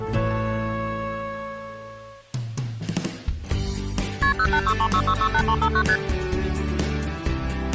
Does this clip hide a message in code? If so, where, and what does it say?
Yes: multi-frequency trunk signalling (R1, as on North American trunks) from 4.2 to 6.0 s, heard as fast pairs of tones, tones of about 70 ms. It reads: KP 08636668359 ST